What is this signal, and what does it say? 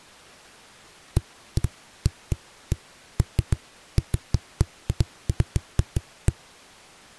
Irregular knocks on a wall. There is no code.